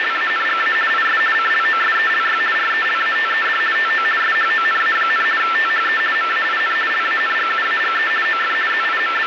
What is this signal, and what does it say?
RTTY (50 baud, 450 Hz shift), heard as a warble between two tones, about 1550 Hz centre, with radio static. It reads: … IS CLOSELY RELATED TO SHONA, THE MAIN LANGUAGE OF …